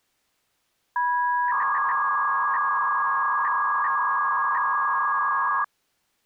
300-baud modem data (V.21 tones), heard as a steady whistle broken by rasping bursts, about 300 baud, 200 Hz shift.